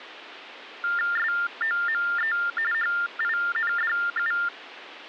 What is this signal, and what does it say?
TTY/TDD text telephone tones (45.45 baud Baudot), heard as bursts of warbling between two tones, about 400 Hz shift, 1600 Hz centre, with phone line noise. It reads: SOME HINDU